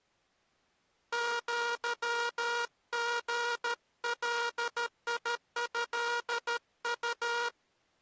Morse code (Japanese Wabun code), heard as a buzzer, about 13 wpm. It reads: アリガトウ